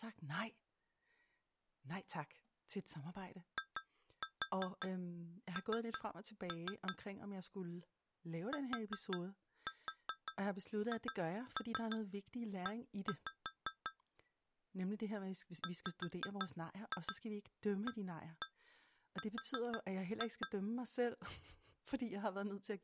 Tap code, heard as taps on glass, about 5 knocks a second, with speech in Danish. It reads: IN THE WAR